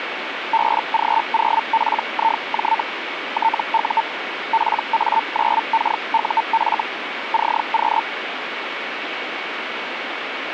Hellschreiber (Feld-Hell, 122.5 baud), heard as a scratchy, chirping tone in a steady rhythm, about 900 Hz, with radio static. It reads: BG0PIJ TU PA9KUF CQ